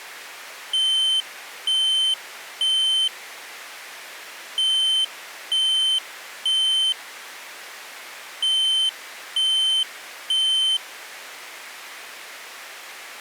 Alarm pattern, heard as an alarm's beeps, played three times, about 3100 Hz. Temporal three. Smoke or fire, evacuate.